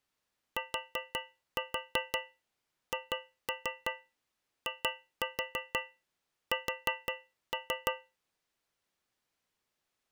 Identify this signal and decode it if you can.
Tap code, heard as taps on a metal pipe, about 5 knocks a second. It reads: THIS